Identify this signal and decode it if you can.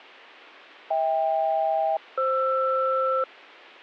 Aircraft SELCAL, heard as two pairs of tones. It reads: HK-FR